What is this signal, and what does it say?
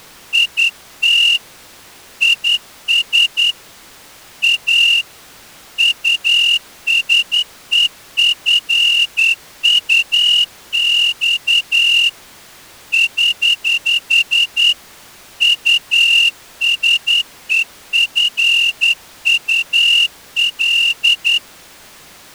Morse code, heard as a whistle, hand-sent with a straight key, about 10 wpm. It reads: IT IS A USEFUX <HH> USEFUL